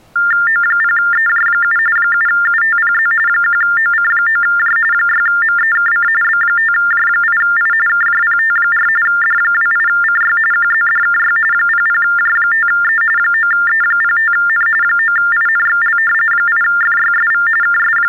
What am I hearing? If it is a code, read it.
TTY/TDD text telephone tones (45.45 baud Baudot), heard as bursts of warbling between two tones, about 400 Hz shift, 1600 Hz centre. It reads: O0EJ7 7UTPZ 1OC9J 6MEKC B5J8I KJPT4 D28CY QZDKY 00J5E 9E05N 9INXL 8FYSV …